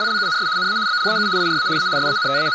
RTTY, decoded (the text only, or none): … NA BLAU IRA A …